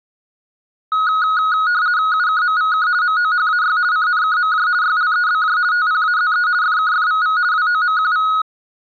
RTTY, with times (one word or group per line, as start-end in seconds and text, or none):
2.1-2.9 UKMVK
3.0-3.8 MOHAY
3.9-4.7 CNKMJ
4.8-5.6 YLEBJ
5.7-6.5 TPAZE
6.6-7.4 FKFVV
7.5-8.3 WOMQV